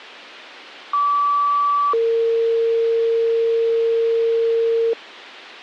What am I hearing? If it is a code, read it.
Two-tone page, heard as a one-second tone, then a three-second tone, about 1150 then 460 Hz.